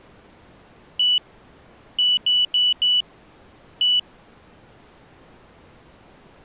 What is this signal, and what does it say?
Beep code, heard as a piezo beeper, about 2950 Hz. 1-4-1. In Phoenix BIOS tables: address line failure in the first 64 KB of memory.